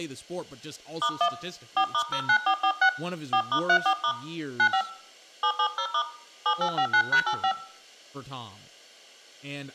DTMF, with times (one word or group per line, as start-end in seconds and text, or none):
1.0-1.3 *1
1.8-2.9 4*09446
3.3-4.1 4*34*
4.6-4.8 95
5.4-6.0 770*
6.5-7.5 7859#85